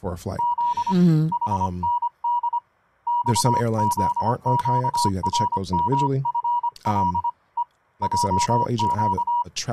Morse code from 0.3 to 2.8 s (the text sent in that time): Z HND